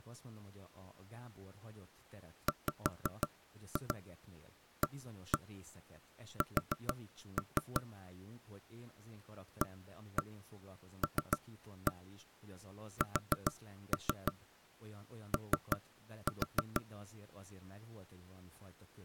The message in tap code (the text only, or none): WAS ALSO